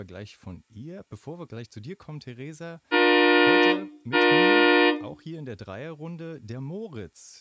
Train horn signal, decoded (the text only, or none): 2 short